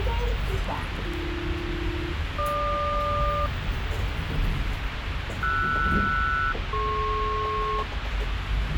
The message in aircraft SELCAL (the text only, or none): AB-GQ RS-DP